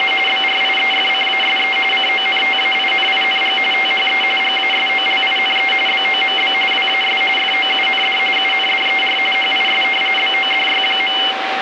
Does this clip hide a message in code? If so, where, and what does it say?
Yes: RTTY (45.45 baud, 850 Hz shift) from 0.0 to 11.3 s, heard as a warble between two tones, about 2550 Hz centre, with radio static and a steady whistle near 770 Hz. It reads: … BRIEFCASE CONTAINING THE GASOLINE BOMB WAS FOUND UNDER HIS BODY.